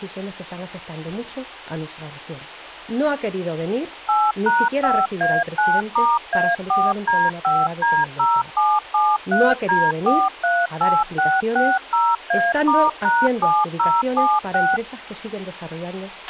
DTMF, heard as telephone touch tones, dialled by machine, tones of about 220 ms, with a squelch burst at the end. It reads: 8#5A9*A4D5D0773D438660A*#7076